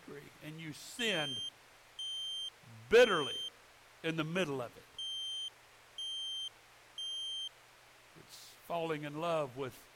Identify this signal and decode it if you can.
Alarm pattern, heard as an alarm's beeps, played twice, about 3150 Hz, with speech in English. Temporal three. Smoke or fire, evacuate.